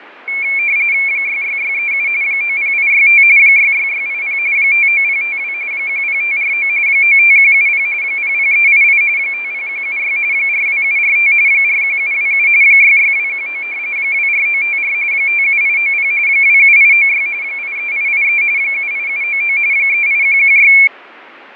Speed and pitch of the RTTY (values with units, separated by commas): 45.45 baud, 170 Hz shift, 2300 Hz centre